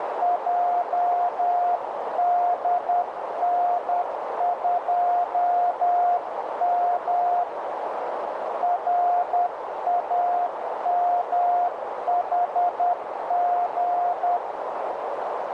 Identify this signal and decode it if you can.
Morse code, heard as a keyed tone, hand-sent with a paddle, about 10 wpm, 710 Hz, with heavy radio static and a narrow filter. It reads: JDN2M RAMHG